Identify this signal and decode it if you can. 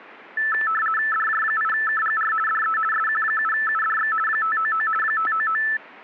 RTTY (50 baud, 450 Hz shift), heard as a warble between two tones, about 1550 Hz centre, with static crashes. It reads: DJ8KGR DE SQ7UDX 599 599